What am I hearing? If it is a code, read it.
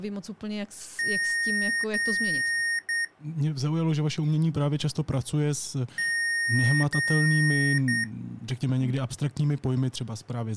Beep code, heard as beeps from a small speaker, played twice, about 1850 Hz, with speech in Czech. 2 long, 1 short.